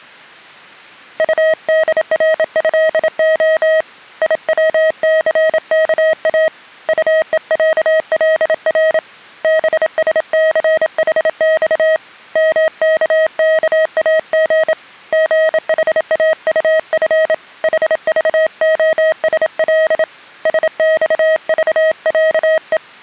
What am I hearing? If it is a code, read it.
Morse code (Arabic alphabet), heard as a keyed tone, hand-sent with a bug key, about 27 wpm, 630 Hz. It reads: طدرهخ يوثكا طءعلر بسثحص مككاغ غحاطف حضخسل سصضعء